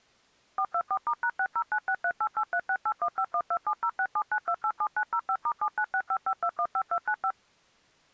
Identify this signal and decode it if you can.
DTMF, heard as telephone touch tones, dialled by machine, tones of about 70 ms. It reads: 424*#6096388368151270679287905*79655215295